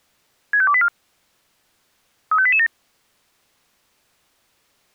Five-tone selective call (ZVEI), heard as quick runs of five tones, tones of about 70 ms. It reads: 65284 35887